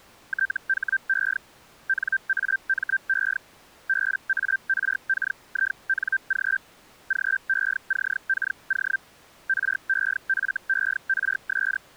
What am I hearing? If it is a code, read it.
Hellschreiber (Feld-Hell, 122.5 baud), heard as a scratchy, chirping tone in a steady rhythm, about 1550 Hz. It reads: THE NAME BARKING GECKO REFERS